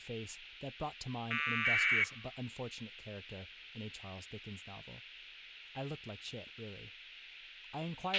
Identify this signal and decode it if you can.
Packet radio (AX.25, as in APRS), 1200 baud, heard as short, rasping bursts, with a squelch burst at the end and speech in English.